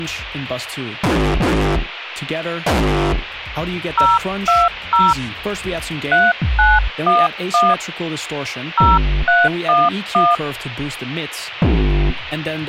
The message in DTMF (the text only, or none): 020 3911 0311